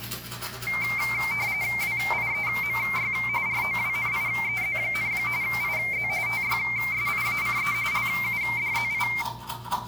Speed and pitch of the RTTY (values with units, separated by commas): 45.45 baud, 170 Hz shift, 2200 Hz centre